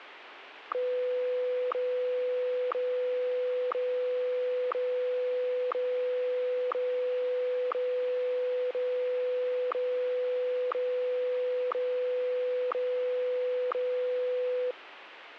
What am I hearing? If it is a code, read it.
Radio time signal (WWVH, Hawaii), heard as ticks, one a second, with radio static.